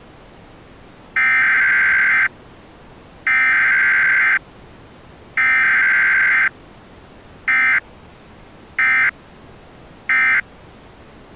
Emergency Alert System (SAME) tones (header bursts, then end-of-message bursts), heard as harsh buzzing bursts, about 520.83 baud.